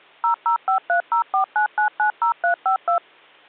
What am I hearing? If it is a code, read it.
DTMF, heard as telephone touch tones, dialled by machine, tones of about 100 ms. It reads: 0053049990352